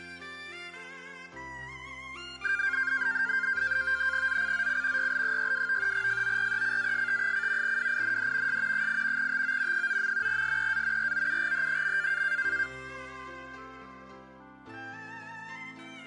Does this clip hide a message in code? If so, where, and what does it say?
Yes: NAVTEX (SITOR-B), 100 baud, 170 Hz shift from 2.4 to 12.7 s, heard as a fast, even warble, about 1500 Hz centre. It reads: ZCZC YL62 FORECAST: WIND S 8 TO 9. SEA ROUGH.